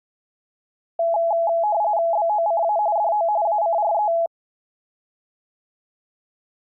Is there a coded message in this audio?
Yes: RTTY (45.45 baud, 170 Hz shift) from 1.0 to 4.3 s, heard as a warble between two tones, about 760 Hz centre. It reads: BOCA DO ACRE